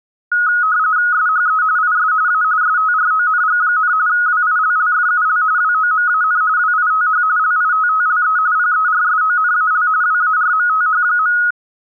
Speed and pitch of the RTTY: 45.45 baud, 170 Hz shift, 1360 Hz centre

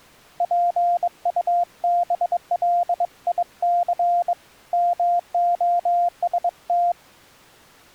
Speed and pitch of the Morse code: 22 wpm, 700 Hz

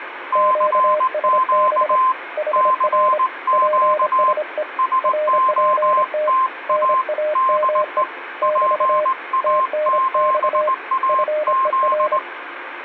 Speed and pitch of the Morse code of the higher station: 19 wpm, 1050 Hz

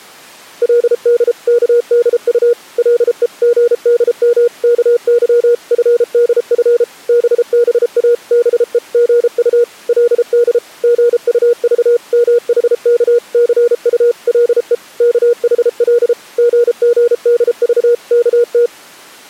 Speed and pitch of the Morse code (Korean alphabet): 33 wpm, 480 Hz

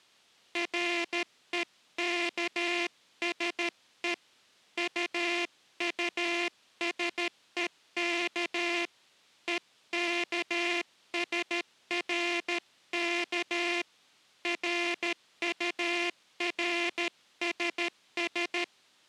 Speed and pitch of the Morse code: 13 wpm

